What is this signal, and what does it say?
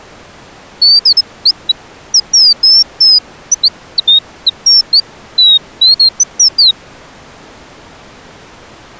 Bird-like chirps. There is no code.